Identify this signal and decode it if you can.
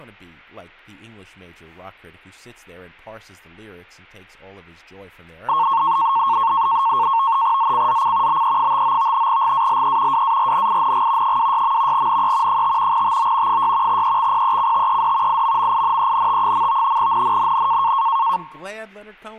NAVTEX (SITOR-B), 100 baud, 170 Hz shift, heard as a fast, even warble, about 1000 Hz centre, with speech in English. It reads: ZCZC BE59 GALE WARNING 26. NE 5 TO 6 EXPECTED IMMINENT. NNNN